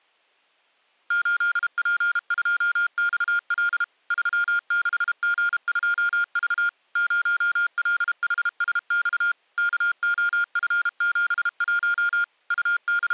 Morse code, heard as electronic beeps, machine-sent, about 32 wpm, 1410 Hz. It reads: 8P2XL 36G2V 0LHSX KOF71 …